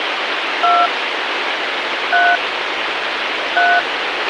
DTMF, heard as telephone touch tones, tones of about 230 ms, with radio hiss and a squelch burst at the end. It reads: 2 3 3